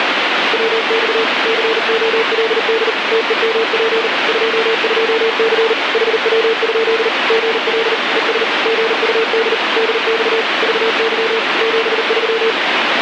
Morse code, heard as a keyed tone, machine-sent, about 39 wpm, 450 Hz, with heavy radio static. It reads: WX COLD TEMP 22C HW? GL ES GUD DX VY 73